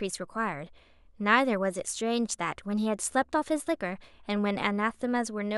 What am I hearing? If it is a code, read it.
Speech in English. There is no code.